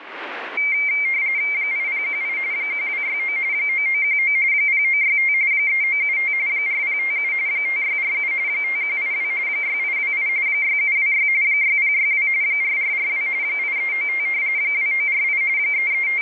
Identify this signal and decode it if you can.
RTTY (45.45 baud, 170 Hz shift), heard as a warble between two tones, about 2200 Hz centre, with radio static. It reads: 8018 1269 9919 0965 3975 4057 5647 5182 6828 6726 6062 4442 8395 2948 …